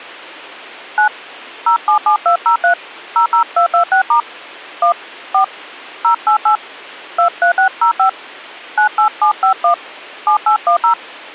DTMF, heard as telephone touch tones, dialled by hand, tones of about 100 ms. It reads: 9 077203 00226* 1 4 088 23605 98751 7810